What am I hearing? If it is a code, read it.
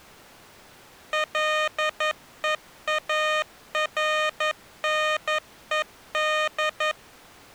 Morse code, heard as electronic beeps, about 11 wpm, 620 Hz. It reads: LEARNED